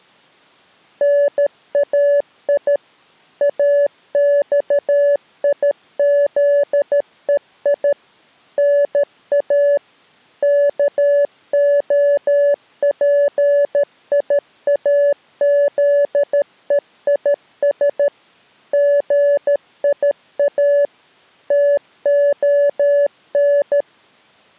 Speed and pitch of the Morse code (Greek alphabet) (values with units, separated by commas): 13 wpm, 570 Hz